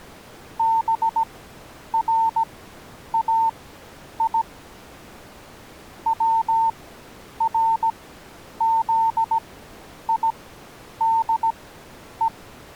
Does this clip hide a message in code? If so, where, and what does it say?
Yes: Morse code (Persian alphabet) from 0.5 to 12.3 s, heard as a keyed tone, machine-sent, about 17 wpm, spaced as for 9 wpm, 900 Hz. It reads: برای ورزیده